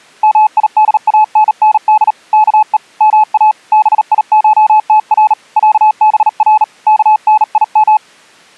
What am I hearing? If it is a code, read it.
Morse code (Persian alphabet), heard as a keyed tone, hand-sent with a bug key, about 38 wpm, 860 Hz. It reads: میدانند که ما بیشتر صبر کنیم